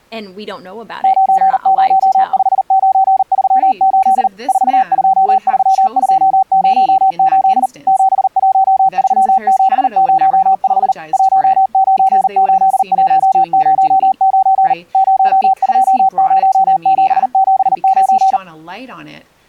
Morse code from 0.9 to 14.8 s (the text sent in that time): 905938 423208 713705 198109